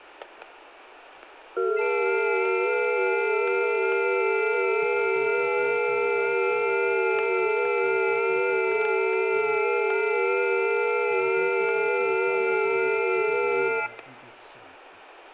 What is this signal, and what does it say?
FT8 (several signals at once), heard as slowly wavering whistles, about 6.25 baud, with static crashes.